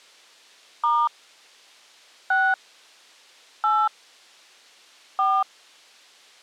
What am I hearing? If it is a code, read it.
DTMF, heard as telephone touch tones, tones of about 240 ms. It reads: * 6 8 4